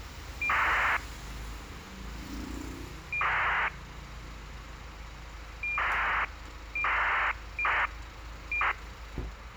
ACARS aircraft data, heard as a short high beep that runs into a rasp, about 2400 baud, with radio hiss and street noise.